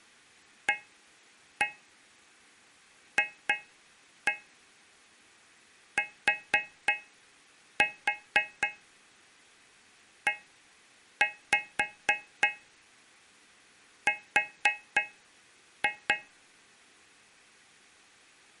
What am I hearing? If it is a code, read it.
Tap code, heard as taps on a metal pipe, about 3 knocks a second. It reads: AFTER